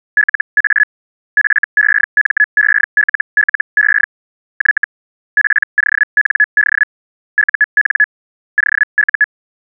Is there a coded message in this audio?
Yes: Hellschreiber (Feld-Hell, 122.5 baud) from 0.2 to 9.2 s, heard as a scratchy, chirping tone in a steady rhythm, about 1700 Hz. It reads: LA FEMELLE Y POND UN OU